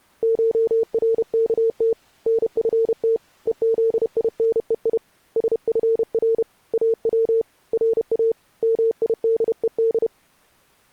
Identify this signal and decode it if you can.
Morse code (Persian alphabet), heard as a keyed tone, hand-sent with a paddle, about 31 wpm, 450 Hz. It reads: شرکت نفت هزینهی سفر او را میدهد